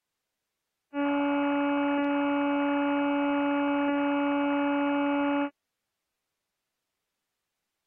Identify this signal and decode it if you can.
Ship horn signal, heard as a ship's horn, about 280 Hz. 1 long. At sea: a vessel nearing a blind bend, or under power and making way in fog.